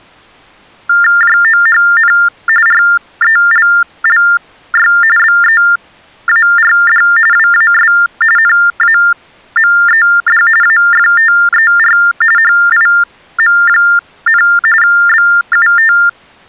TTY/TDD text telephone tones (45.45 baud Baudot), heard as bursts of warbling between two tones, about 400 Hz shift, 1600 Hz centre. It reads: JOHN RELLY BEARD WAS NAMED AFTER HIM, BUT